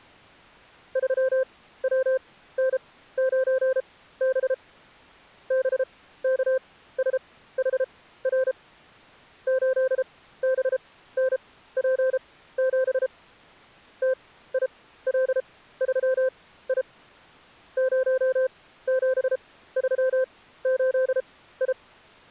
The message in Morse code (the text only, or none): 3WN9B BKSHR 8BNP7 TIL3I 0738I